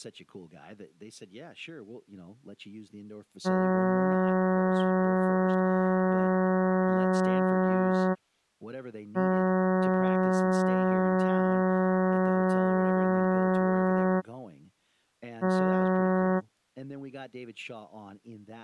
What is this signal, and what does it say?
Ship horn signal, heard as a ship's horn, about 190 Hz, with speech in English. 2 long, 1 short. At sea: I intend to overtake on your starboard side.